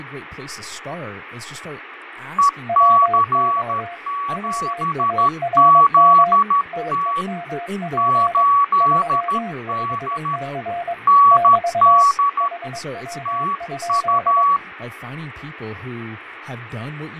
Morse code, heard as two keyed tones, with radio static, fading and speech in English. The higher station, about 13 wpm, 1130 Hz: EC7ZT 8D ND TU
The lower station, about 22 wpm, 700 Hz: WX WARM TEMP 35C <BT> HW?